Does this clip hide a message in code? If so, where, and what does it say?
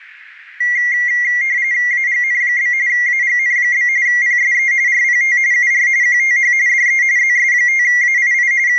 Yes: RTTY (45.45 baud, 170 Hz shift) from 0.6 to 8.8 s, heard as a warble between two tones, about 2050 Hz centre. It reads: AGN? AGN? PSE RPT UR QTH DE ZS5AII …